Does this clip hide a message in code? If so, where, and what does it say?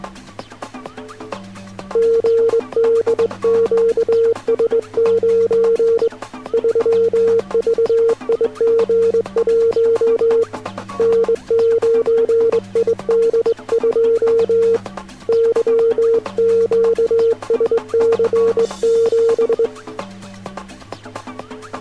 Yes: Morse code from 1.9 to 19.7 s, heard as a keyed tone, hand-sent with a straight key, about 22 wpm, 460 Hz. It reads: GDQS9 3VIG1 N9ID2 YQSC7